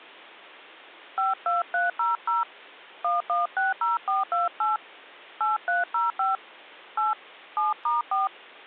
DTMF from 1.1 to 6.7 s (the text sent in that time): 52300 1160428 8305